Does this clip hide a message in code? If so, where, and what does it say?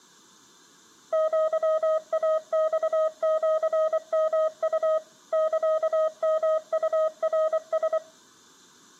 Yes: Morse code (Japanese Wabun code) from 1.1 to 8.0 s, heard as a keyed tone, machine-sent, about 24 wpm, 630 Hz, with room echo. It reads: アイマシヨウ サヨウナラ